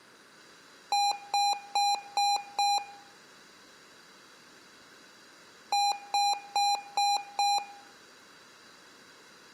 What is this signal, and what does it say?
Beep code, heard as beeps from a small speaker, played twice, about 810 Hz, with room echo. 5 short. In AMI BIOS tables: processor failure; in Dell tables: CMOS battery failure.